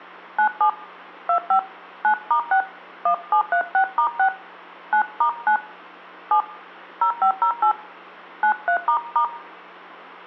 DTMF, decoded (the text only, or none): 97 25 9*6 1736*6 9*9 7 0508 93**